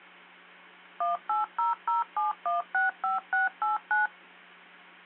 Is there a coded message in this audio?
Yes: DTMF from 1.0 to 4.1 s, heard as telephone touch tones, dialled by machine, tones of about 150 ms, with hum. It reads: 18007165689